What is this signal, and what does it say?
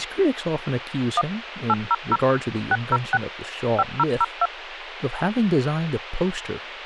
DTMF, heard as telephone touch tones, dialled by machine, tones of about 40 ms, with radio hiss and speech in English. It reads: 1 800 606 5002